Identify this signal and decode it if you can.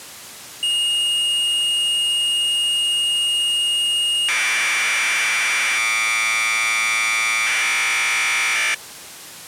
Commodore tape loading (standard loader), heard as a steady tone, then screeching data.